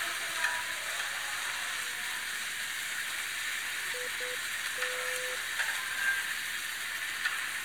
Morse code, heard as a keyed tone, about 9 wpm, 500 Hz, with the noise of a restaurant. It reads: IT